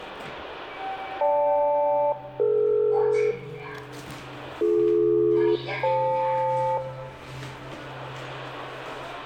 Aircraft SELCAL, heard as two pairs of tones, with room echo and the noise inside a lift. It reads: GL-DE BD-FL